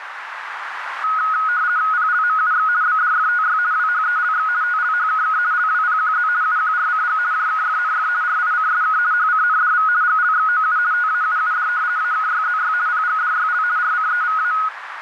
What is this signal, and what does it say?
RTTY (50 baud, 170 Hz shift), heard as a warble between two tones, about 1360 Hz centre, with radio static and a narrow filter. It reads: PLMUX BDFTY WHELX TLHKK LWPQZ UQRCG JKFNF RICSK HCNDV GLXOU TAUUD AKYZY PGDYL RCEVA